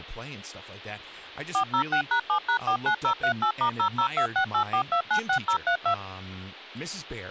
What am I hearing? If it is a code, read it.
DTMF, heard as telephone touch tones, dialled by machine, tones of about 90 ms, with speech in English. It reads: 406#7#49038*002684296032